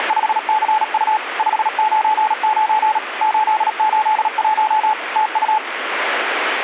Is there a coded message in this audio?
Yes: Morse code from 0.0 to 5.6 s, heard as a keyed tone, machine-sent, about 37 wpm, 860 Hz, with radio static. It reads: … 599 881 TU